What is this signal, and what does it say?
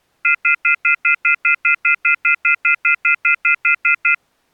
Telephone call progress tone (North American plan), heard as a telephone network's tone, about 1400, 2050, 2450, 2600 Hz, 0.1 s on and 0.1 s off. Off-hook warning tone.